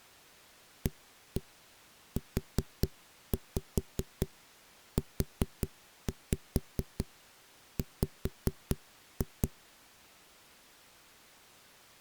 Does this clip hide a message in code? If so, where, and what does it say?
Yes: tap code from 0.9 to 9.5 s, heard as knocks on a wall, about 4 knocks a second. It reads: AUUW